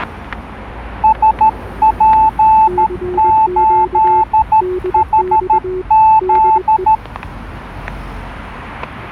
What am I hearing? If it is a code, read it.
Morse code, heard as two keyed tones, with static crashes and street noise. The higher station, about 13 wpm, 880 Hz: SP8HZ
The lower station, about 21 wpm, 370 Hz: CQ DX DE